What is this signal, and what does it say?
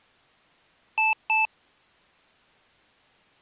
Beep code, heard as beeps from a small speaker, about 880 Hz. 2 short. In AMI BIOS tables: memory parity error; in IBM BIOS tables: self-test error shown on screen; in Dell tables: no memory detected.